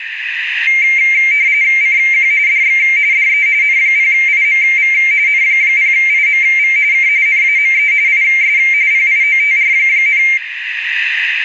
RTTY (45.45 baud, 170 Hz shift), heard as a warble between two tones, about 2200 Hz centre, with radio static and room echo. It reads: CQ DX DE N0IMV N0IMV K NAME IS PIOTR,